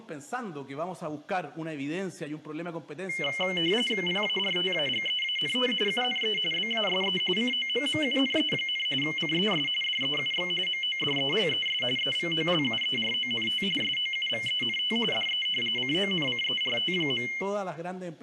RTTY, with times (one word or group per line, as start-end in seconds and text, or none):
4.1-5.7 PARTAGEANT
5.9-6.4 UNE
6.5-7.2 BASE
7.4-8.9 COMMUNE,
9.0-9.7 CES
9.8-10.5 DEUX
10.7-11.8 MODELES
12.0-13.6 EVOLUERONT
13.8-15.0 SOUVENT
15.1-15.5 DE
15.8-17.3 CONCERT.